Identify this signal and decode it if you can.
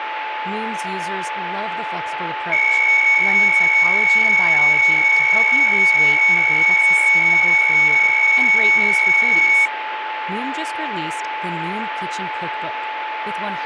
PSK63 (62.5 baud), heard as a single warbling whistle, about 2250 Hz, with radio static, a steady whistle near 870 Hz and speech in English.